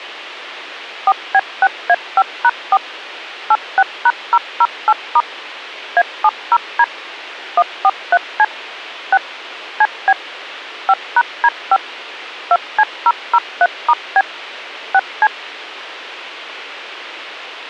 DTMF, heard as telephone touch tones, dialled by machine, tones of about 50 ms. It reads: 4B6A5#4 86#008* A70D 143C 6 CB 5#D5 2C003*B 6C